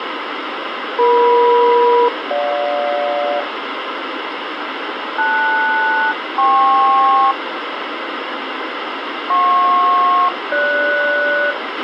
Aircraft SELCAL, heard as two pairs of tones, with radio hiss and a squelch burst at the end. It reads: EM-GJ LS-KP JP-GS